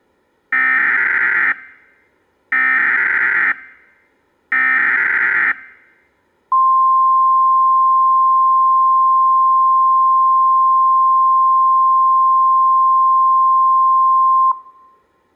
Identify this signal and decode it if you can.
Emergency Alert System (SAME) tones (header bursts, then the 1050 Hz attention tone), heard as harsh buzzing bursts, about 520.83 baud.